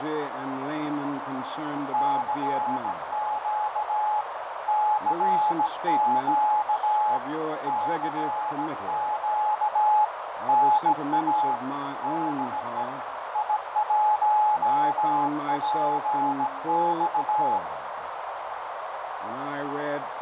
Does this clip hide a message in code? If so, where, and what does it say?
Yes: Morse code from 1.9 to 17.6 s, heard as a keyed tone, hand-sent with a bug key, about 17 wpm, 850 Hz, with heavy radio static, fading and a narrow filter. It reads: CQ CQ CQ NA DE I1PX